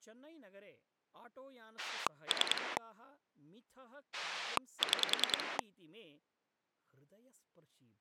Pulse dialling, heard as a rotary dial, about 10 pulses a second, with speech in Sanskrit. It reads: 3 6